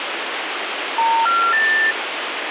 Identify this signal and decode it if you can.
Telephone call progress tone (North American plan), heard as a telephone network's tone, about 910, 1370, 1800 Hz, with phone line noise. Special information tone.